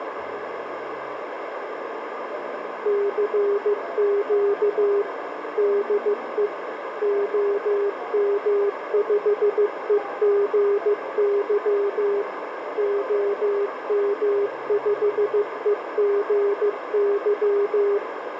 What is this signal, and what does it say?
Morse code, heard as a keyed tone, machine-sent, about 15 wpm, 400 Hz, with radio static and a narrow filter. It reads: CQ DE OM5EGY OM5EGY